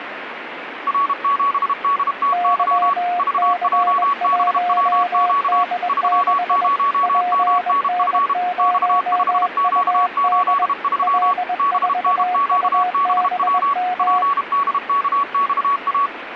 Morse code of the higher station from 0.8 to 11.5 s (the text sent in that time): R7DTY VJBWQ 30MNF X5Q83